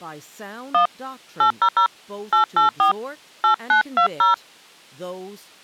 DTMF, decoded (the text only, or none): 1 800 884 8920